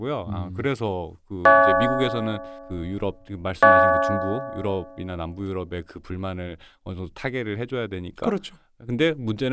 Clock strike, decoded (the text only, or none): 2